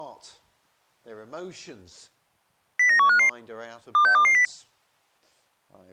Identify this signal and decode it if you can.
Five-tone selective call (CCIR), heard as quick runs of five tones, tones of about 100 ms. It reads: 09155 26220